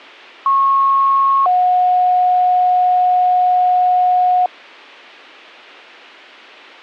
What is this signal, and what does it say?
Two-tone page, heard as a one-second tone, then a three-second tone, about 1090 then 730 Hz, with a squelch burst at the end.